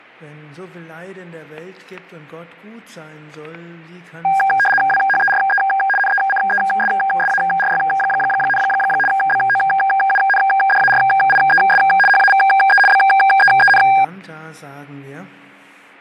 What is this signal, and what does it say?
RTTY (75 baud, 850 Hz shift), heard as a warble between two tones, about 1200 Hz centre, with fading and static crashes. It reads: WHERE NECESSARY, BOUNDARIES HAVE BEEN